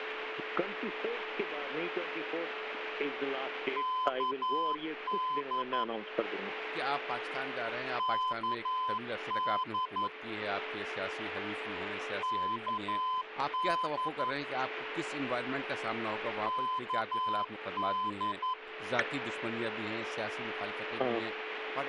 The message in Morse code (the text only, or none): KD KD KD KD